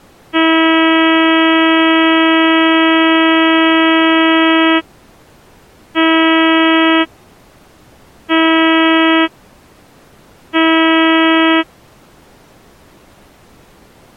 Ship horn signal, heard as a ship's horn, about 320 Hz. 1 long, 3 short. At sea: a vessel under tow in fog.